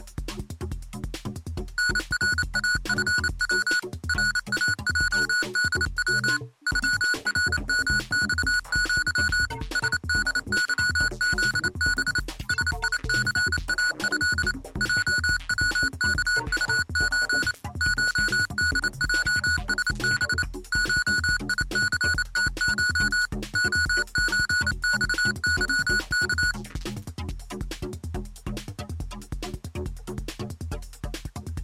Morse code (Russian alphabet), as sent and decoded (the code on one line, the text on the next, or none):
-. .-. .- ..-. .-- / .-. .- .--- -.. .-- / ..-- .-. -- -..- --.-- / ... -.. -.-- --.. -... / ... .. -.-. .- ..-.. / .--- .-- -.- ..- ---. / ---- -.. .--- ... -... / ---- .. -.-. - ---- / --- ---. -..- -.-- -.-
НРАФВ РАЙДВ ЮРМЬЪ СДЫЗБ СИЦАЭ ЙВКУЧ ШДЙСБ ШИЦТШ ОЧЬЫК